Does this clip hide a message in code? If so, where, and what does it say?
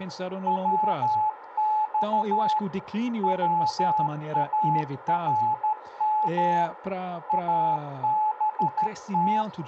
Yes: Morse code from 0.4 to 9.5 s, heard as a keyed tone, machine-sent, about 13 wpm, 860 Hz, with radio static, a narrow filter, room echo and speech in Portuguese. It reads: WX WARM ABT